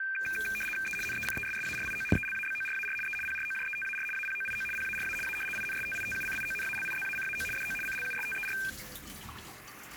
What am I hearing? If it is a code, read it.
RTTY (75 baud, 850 Hz shift), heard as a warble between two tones, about 2000 Hz centre, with kitchen noise. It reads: E NECESSARIO ELABORAR E PROJETAR APOIO PARA A INSTITUCIONALIZACAO DO CLUSTER